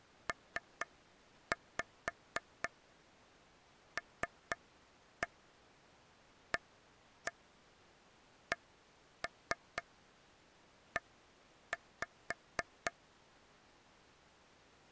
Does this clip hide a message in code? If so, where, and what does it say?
Yes: tap code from 0.3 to 12.9 s, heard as taps on a table, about 4 knocks a second. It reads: PLACE